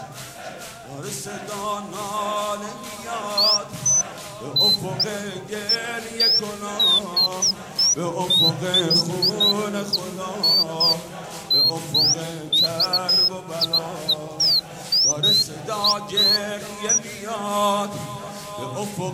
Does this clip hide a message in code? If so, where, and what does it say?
No, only bird-like chirps.